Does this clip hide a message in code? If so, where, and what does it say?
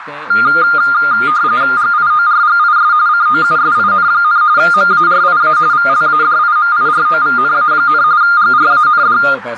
Yes: RTTY (45.45 baud, 170 Hz shift) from 0.3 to 9.3 s, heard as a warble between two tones, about 1310 Hz centre, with radio static, a narrow filter and speech in Hindi. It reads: GIORGIS COUSIN, MARIA VLADIMIROVNA, GRAND